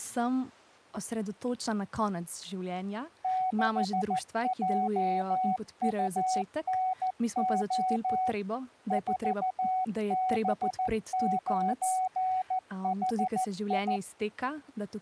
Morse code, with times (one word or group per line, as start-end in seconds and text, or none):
3.2-8.3 6JUNO
8.9-14.0 4B9HI